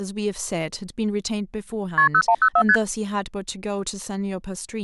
Multi-frequency trunk signalling (R1, as on North American trunks), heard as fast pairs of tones, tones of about 70 ms, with speech in English. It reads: KP 0104 ST